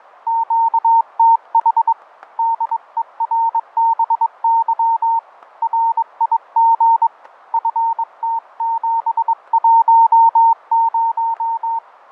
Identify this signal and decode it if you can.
Morse code, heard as a keyed tone, hand-sent with a bug key, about 22 wpm, 910 Hz, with fading and static crashes. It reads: QTH DERBY RIG FT710